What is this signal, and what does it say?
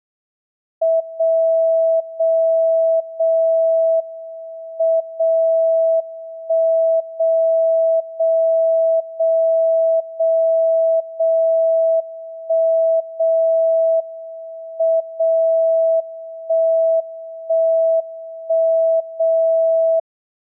Radio time signal (WWVB), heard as a tone whose level steps once a second, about 650 Hz. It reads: 0 0 0 M 0 1 0 0 0 0 0 1 0 M 0 1 1 1 0